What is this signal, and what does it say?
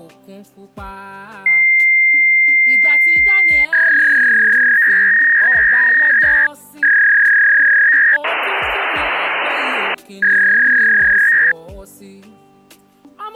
Fax machine handshake, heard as a long tone, a warble and hiss.